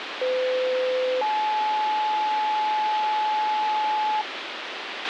Two-tone page, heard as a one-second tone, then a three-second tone, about 510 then 860 Hz, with radio hiss and a squelch burst at the end.